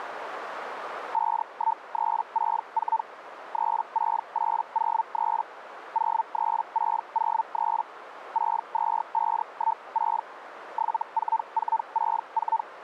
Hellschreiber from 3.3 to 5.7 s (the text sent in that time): 36803